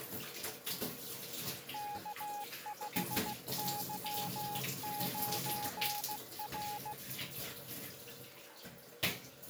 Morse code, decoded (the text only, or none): K5Y9R